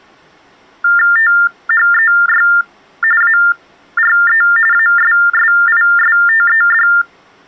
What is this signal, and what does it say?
TTY/TDD text telephone tones (45.45 baud Baudot), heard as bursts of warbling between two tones, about 400 Hz shift, 1600 Hz centre. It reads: THEY ARE ASSISTED